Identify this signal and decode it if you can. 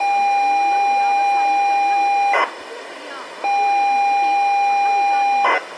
ZX Spectrum tape loading, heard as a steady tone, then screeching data, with tape hiss, room echo and speech in Sanskrit.